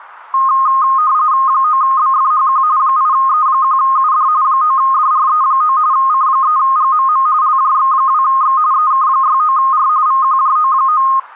RTTY (45.45 baud, 170 Hz shift), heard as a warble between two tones, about 1150 Hz centre. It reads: 9BFHQ 8E1UD 9DRE9 C3GMM LJX2X EK69R VQJO9